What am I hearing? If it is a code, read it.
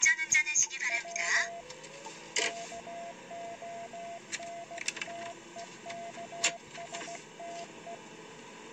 Morse code (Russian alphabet), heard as a keyed tone, hand-sent with a paddle, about 16 wpm, 680 Hz, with the noise inside a car. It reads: В КОНТЕКСТЕ